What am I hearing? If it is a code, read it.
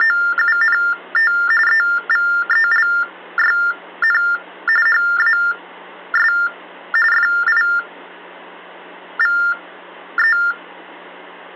TTY/TDD text telephone tones (45.45 baud Baudot), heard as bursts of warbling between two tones, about 400 Hz shift, 1600 Hz centre. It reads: … EVELYN HAS FIVE